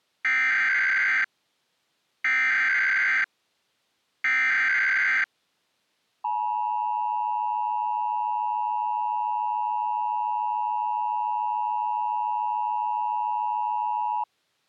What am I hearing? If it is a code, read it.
Emergency Alert System (SAME) tones (header bursts, then the 853 and 960 Hz attention tone), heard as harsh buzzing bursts, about 520.83 baud.